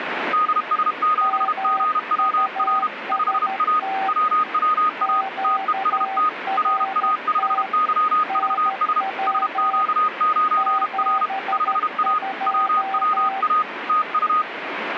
Morse code, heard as two keyed tones, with radio static. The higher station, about 32 wpm, 1240 Hz: DS7GWR 5A WWA TEST RA5YVS SQ9R 5A WWA TU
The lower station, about 13 wpm, 770 Hz: MUST QRT NW 72